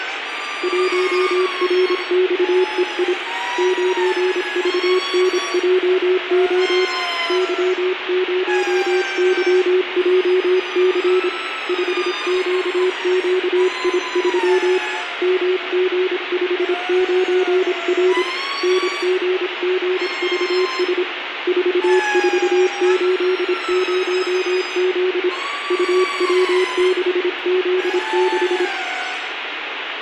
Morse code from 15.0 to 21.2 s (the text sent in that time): MG59R NGGVS